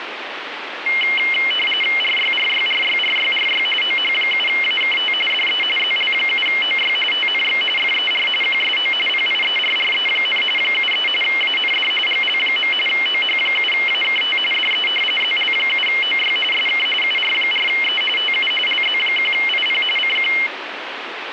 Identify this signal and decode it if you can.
RTTY (45.45 baud, 850 Hz shift), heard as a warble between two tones, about 2550 Hz centre, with radio static. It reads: RYRYRYRYRY OH7AKT DE ZL7OY TNX FER QSO PIERRE, 73 AND GL. OH7AKT DE ZL7OY SK UR4E TU LZ1IP CQ